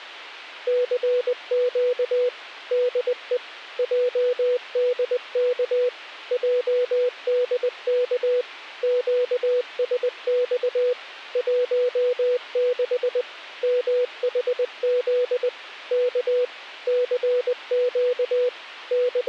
Morse code, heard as a keyed tone, machine-sent, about 20 wpm, 490 Hz. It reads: CQ DE JDK JDK QSX 16 MHZ K CQ …